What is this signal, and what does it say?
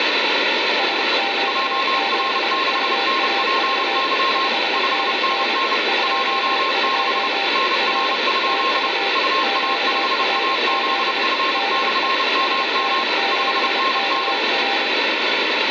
Morse code, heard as two keyed tones, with heavy radio static. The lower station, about 25 wpm, 790 Hz: SQ7UAV 5NN 22 R TU QRZ DE SN7KR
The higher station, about 30 wpm, 1070 Hz: JR6NPY 5NN 16 NR? UA5AZF/MM 5NN